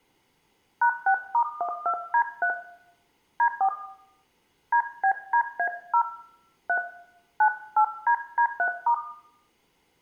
DTMF, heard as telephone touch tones, dialled by hand, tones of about 80 ms, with room echo. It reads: #6*12D3 D4 DBDA0 3 98DD3*